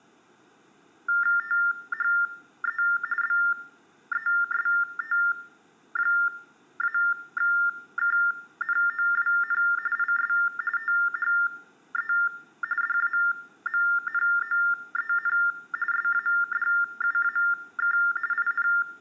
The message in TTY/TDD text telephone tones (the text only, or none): THE BEST-KNOWN IS THE DAMNOEN SADUAK IN